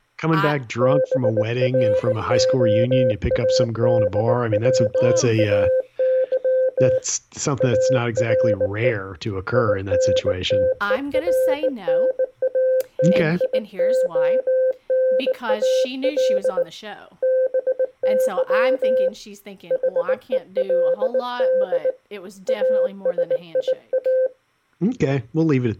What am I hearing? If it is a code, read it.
Morse code, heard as a keyed tone, hand-sent with a bug key, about 19 wpm, 520 Hz, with speech in English. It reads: BROADWAY ARE INTERNATIONAL BY HELD ASIA